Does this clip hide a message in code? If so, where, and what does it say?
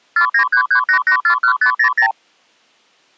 Yes: multi-frequency trunk signalling (R2, with the far end's replies) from 0.2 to 2.1 s, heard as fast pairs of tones, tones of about 90 ms. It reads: 49338841500